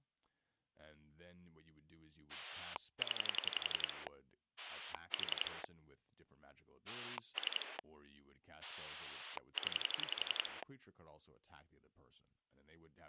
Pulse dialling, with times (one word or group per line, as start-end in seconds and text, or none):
2.3-4.1 0
4.6-5.6 4
6.9-7.8 3
8.6-10.6 0